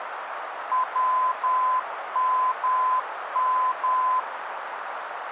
Morse code, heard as a keyed tone, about 10 wpm, 1020 Hz, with radio static and a narrow filter. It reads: WMM